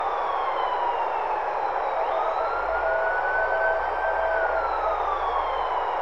Morse code, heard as a keyed tone, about 17 wpm, 650 Hz, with heavy radio static, a narrow filter and street noise. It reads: HAARE